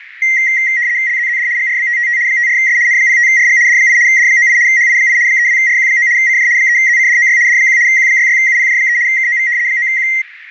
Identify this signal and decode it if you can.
RTTY (75 baud, 170 Hz shift), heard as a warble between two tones, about 2000 Hz centre, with radio static. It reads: LZZD GRBTTT 54S N05RG D8 D98 HI8 32RQ9 CJ 3ZCDOY D1 Q66UPJ3 KOV 9Q